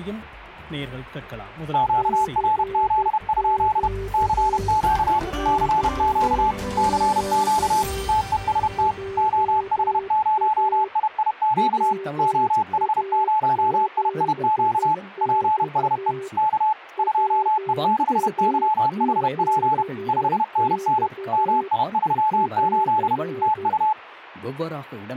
Morse code, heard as two keyed tones. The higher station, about 31 wpm, 860 Hz: QRZ? CQ CQ CQ TEST OH0IIQ OH0IIQ PSE K 2E6YHP 5NN MI38 TU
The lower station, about 12 wpm, 390 Hz: CQ CQ JA WA7X WA7X <AR>